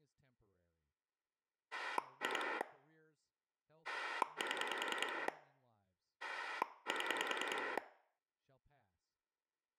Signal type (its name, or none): pulse dialling